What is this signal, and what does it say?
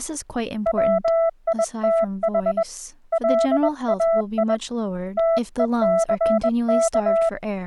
Morse code, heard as a keyed tone, hand-sent with a bug key, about 21 wpm, 660 Hz, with speech in English. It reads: WITH LAI TECK